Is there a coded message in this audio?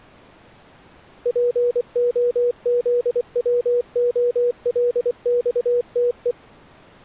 Yes: Morse code (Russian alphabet) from 1.2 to 6.4 s, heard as a keyed tone, machine-sent, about 24 wpm, 480 Hz. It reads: ПОЗВОЛЬТЕ